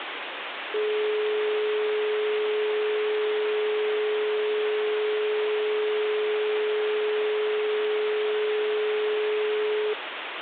Telephone call progress tone (425 Hz plan, as in most of Europe), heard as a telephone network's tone, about 420 Hz, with phone line noise. Dial tone.